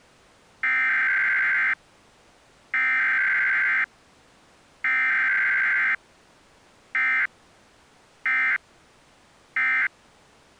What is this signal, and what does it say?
Emergency Alert System (SAME) tones (header bursts, then end-of-message bursts), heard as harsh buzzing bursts, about 520.83 baud.